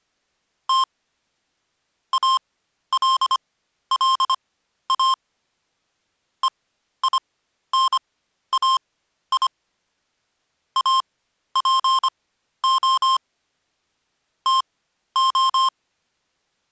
Morse code (Greek alphabet), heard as electronic beeps, machine-sent, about 25 wpm, spaced as for 12 wpm, 1060 Hz. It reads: Τ ΑΛΛΑ ΕΙΝΑΙ ΑΠΟ ΤΟ